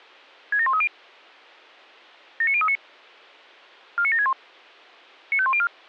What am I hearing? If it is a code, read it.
Five-tone selective call (ZVEI), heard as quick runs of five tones, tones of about 70 ms. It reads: 67130 79039 49761 95104